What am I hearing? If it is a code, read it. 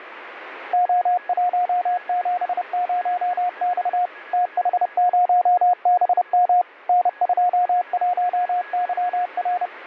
Morse code, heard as a keyed tone, machine-sent, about 30 wpm, 720 Hz, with radio static and a weaker station near 1670 Hz. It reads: O170X TH0BM N21YR